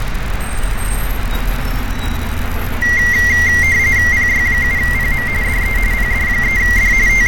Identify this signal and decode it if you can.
RTTY (45.45 baud, 170 Hz shift), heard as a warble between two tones, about 2000 Hz centre, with radio static, fading and street noise. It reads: PY7PM DE PD3D …